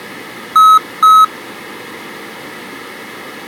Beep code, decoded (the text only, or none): 2 short